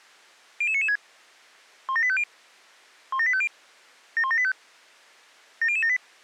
Five-tone selective call (ZVEI), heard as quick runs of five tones, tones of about 70 ms. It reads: 00996 17850 17850 71785 70078